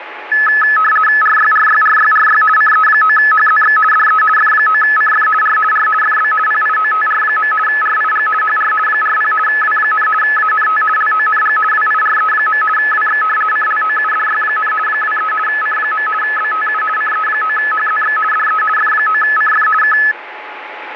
RTTY (50 baud, 450 Hz shift), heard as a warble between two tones, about 1500 Hz centre, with radio static and a steady whistle near 850 Hz. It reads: RYRYRYRY CE9HZX DE F9CF R R FB PIOTR. RIG HR 40 W, ANT LONG WIRE. WX CLOUDY, 23 C. BTU CE9HZX DE F9CF K